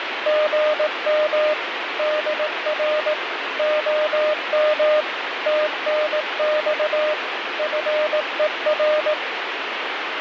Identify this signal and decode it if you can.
Morse code, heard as a keyed tone, machine-sent, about 18 wpm, 610 Hz, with radio static. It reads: GM DR OM TNX FER